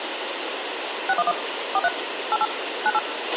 DTMF, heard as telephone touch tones, dialled by machine, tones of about 40 ms, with radio hiss and a squelch burst at the end. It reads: 611 43 88 98